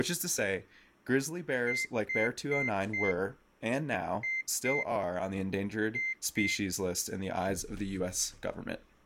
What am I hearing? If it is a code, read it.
Beep code, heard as a piezo beeper, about 2100 Hz, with speech in English. 4-2-2. In Phoenix BIOS tables: shutdown test failure.